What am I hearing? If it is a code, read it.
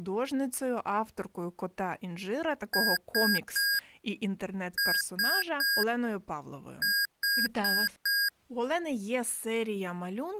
Beep code, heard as beeps from a small speaker, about 1650 Hz, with speech in Ukrainian. 3-3-4. In Phoenix BIOS tables: video failure.